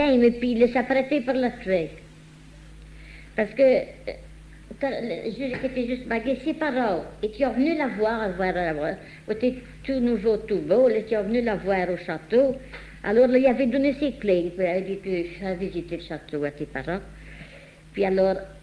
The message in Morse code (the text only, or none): none